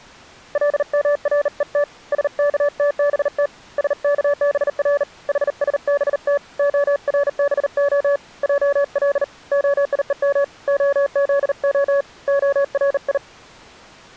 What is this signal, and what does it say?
Morse code (Hebrew alphabet), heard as a keyed tone, hand-sent with a bug key, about 39 wpm, 570 Hz. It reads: למרות שכתבת שכבר חשבת הרבה על היום הזה הרי